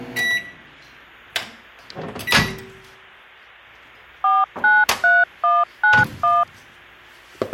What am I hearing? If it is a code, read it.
DTMF, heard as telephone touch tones, dialled by machine, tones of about 200 ms, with kitchen noise. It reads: 493191